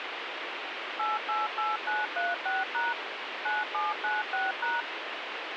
DTMF, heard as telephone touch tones, dialled by machine, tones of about 180 ms, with radio hiss. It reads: 888936# 9796#